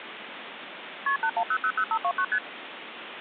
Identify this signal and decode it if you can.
Multi-frequency trunk signalling (R1, as on North American trunks), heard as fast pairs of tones, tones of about 70 ms, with phone line noise. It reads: KP 81000529 ST